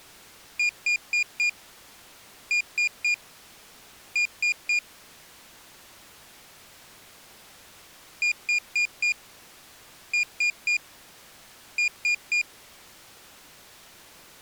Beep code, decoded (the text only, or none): 4-3-3